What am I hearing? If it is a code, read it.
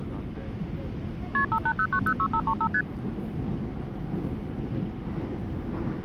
Multi-frequency trunk signalling (R1, as on North American trunks), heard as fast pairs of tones, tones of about 70 ms, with the noise inside a subway train. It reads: KP 580906535 ST